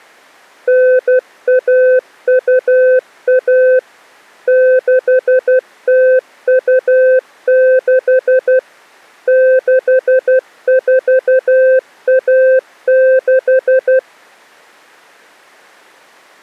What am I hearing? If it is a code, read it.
Morse code (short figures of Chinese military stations), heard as a keyed tone, machine-sent, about 12 wpm, 520 Hz. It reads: 9121 6026 6416